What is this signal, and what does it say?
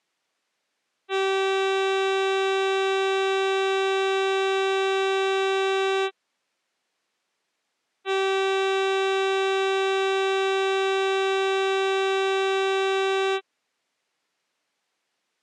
Ship horn signal, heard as a ship's horn, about 390 Hz. 2 long. At sea: a vessel under power that has stopped in fog.